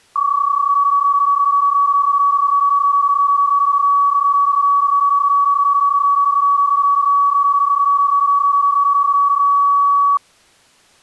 PSK31 (31.25 baud), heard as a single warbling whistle, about 1130 Hz.